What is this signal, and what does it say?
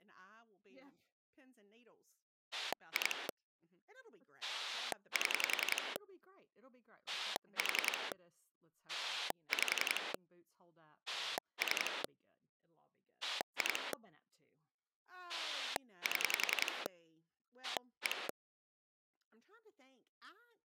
Pulse dialling, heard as a rotary dial, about 11 pulses a second, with speech in English. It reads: 2 7 4 5 3 2 7 1